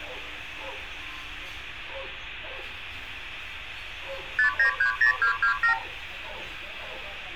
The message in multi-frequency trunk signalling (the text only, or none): 5930227